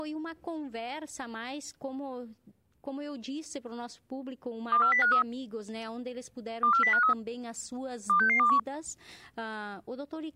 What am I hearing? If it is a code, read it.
Five-tone selective call (CCIR), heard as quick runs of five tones, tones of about 100 ms. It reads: 24053 24053 26621